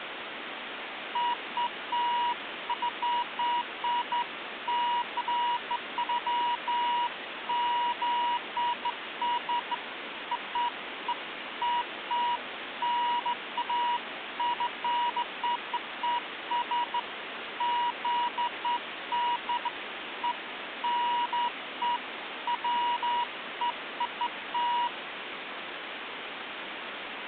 Beeps of irregular length, with phone line noise. There is no code.